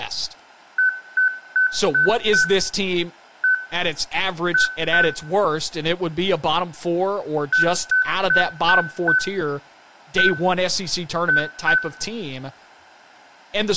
Beep code, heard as beeps, played twice, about 1500 Hz, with room echo and speech in English. 5-1-2.